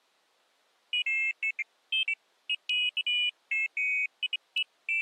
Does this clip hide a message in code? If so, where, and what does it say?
No, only pairs of high tones at irregular times.